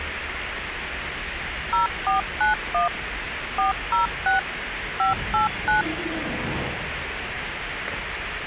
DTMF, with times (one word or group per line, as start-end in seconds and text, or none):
1.7-2.9 0491
3.6-4.4 406
5.0-5.8 589